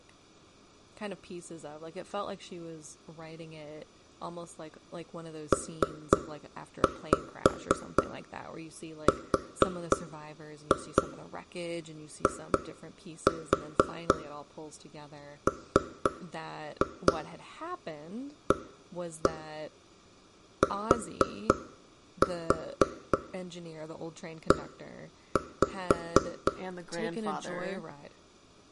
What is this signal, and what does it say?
Tap code, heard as knocks on wood, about 4 knocks a second, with room echo and speech in English. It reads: PRIMATE